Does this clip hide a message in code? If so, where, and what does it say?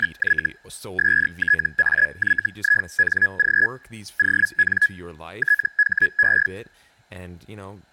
Yes: Hellschreiber (Feld-Hell, 122.5 baud) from 0.0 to 6.5 s, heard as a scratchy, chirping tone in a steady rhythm, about 1700 Hz, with speech in English. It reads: … STAYING ON THE